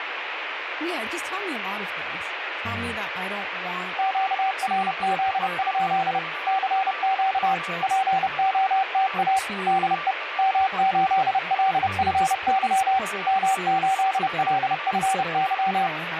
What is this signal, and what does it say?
Morse code, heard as a keyed tone, machine-sent, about 30 wpm, 770 Hz, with radio static, a weaker station near 1170 Hz and speech in English. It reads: QRZ? CQ POTA DE M8LFY M8LFY